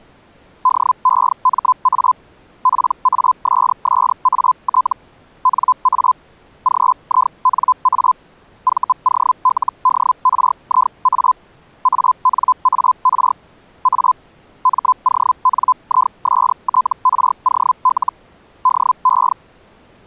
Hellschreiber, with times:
0.6-2.1 DEMA
2.6-4.9 PASSAT
5.4-6.1 NA
6.6-8.1 GINA
8.6-11.3 VOLDRIA
11.8-13.3 ANAR
13.8-14.1 A
14.6-18.1 MONISTROL
18.6-19.3 DE

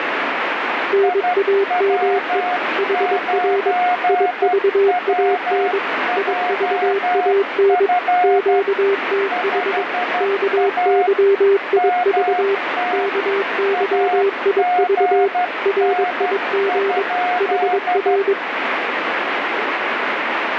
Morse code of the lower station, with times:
0.9-2.4 NAME
2.8-3.7 HR
4.1-5.8 IVAN
6.2-7.9 IVAN
8.2-9.8 QTH
10.2-12.5 KYIV
12.9-15.3 KYIV
15.7-17.0 RIG
17.4-18.3 HR

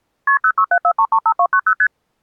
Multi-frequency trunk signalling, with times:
0.3-0.4 KP
0.4-1.7 0674335290
1.8-1.9 ST

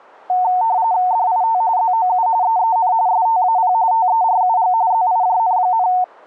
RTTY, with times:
1.1-1.6 DIT
1.8-2.3 ZOU
2.4-2.9 EEN
3.1-3.7 STAP
3.9-4.7 TERUG
4.9-5.9 ZIJN,

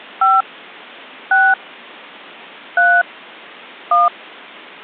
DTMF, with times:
0.2-0.4 5
1.3-1.5 6
2.8-3.0 3
3.9-4.1 1

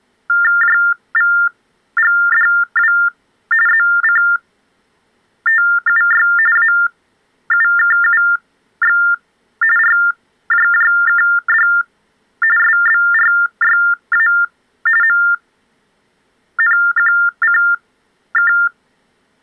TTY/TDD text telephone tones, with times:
0.6-2.9 JVGDW
3.7-6.3 ZCTUY
6.6-9.0 AUKUX
9.8-11.7 RJJKD
12.6-14.3 SBRYA
15.0-18.5 MNQCK

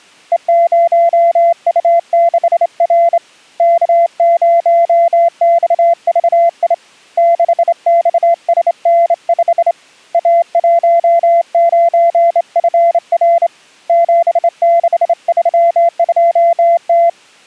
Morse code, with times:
0.3-3.2 E0U6R
3.6-6.7 K0XVI
7.2-9.7 6XSN5
10.1-13.5 A19FR
13.9-17.1 7632T

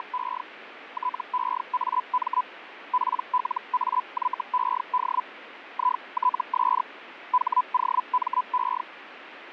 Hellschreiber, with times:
0.0-0.4 …
0.9-2.4 TEAM
2.9-5.2 PLAYED
5.7-6.8 ITS
7.3-8.8 HOME

